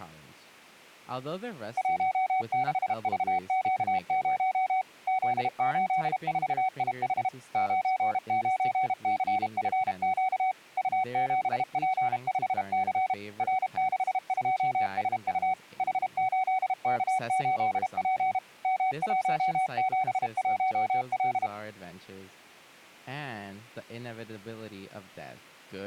Morse code, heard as a keyed tone, machine-sent, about 32 wpm, 750 Hz, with speech in English. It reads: 16VQ0 Z84IH 99CFQ U7P5C R62SU H8K8P M171L